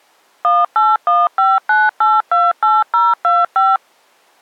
DTMF, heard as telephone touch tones, dialled by machine, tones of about 200 ms. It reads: 18159828025